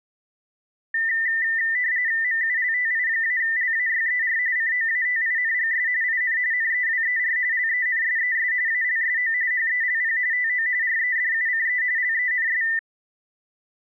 RTTY (45.45 baud, 170 Hz shift), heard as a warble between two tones, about 1900 Hz centre. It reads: MULTI-LAYER COATINGS IN NEWER LENSES ALSO HELP TO REDUCE LENS